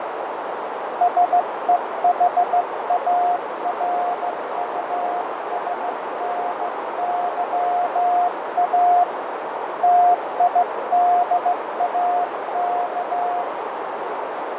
Morse code, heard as a keyed tone, hand-sent with a straight key, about 15 wpm, 710 Hz, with heavy radio static, fading and a narrow filter. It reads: SEHARUSNYA TIDAK